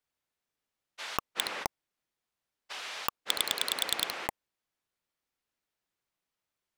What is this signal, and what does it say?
Pulse dialling, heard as a rotary dial, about 10 pulses a second. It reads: 1 8